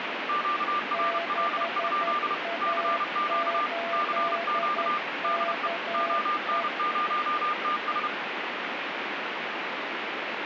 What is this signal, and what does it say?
Morse code, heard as two keyed tones, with radio static. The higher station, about 31 wpm, 1200 Hz: QRL? CQ CQ DE ON0TS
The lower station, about 11 wpm, 680 Hz: 6A8KE